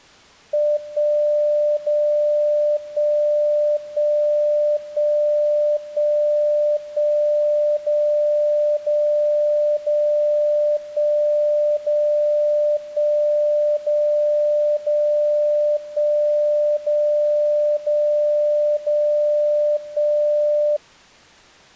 Radio time signal (DCF77), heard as a tone whose level steps once a second, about 590 Hz. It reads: 1 0 1 1 1 1 1 0 0 0 1 0 1 0 0 1 0 0 0 1